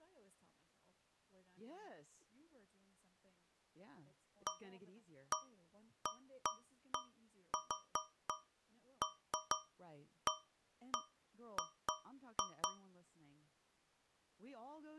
Irregular taps on a metal pipe, with speech in English. There is no code.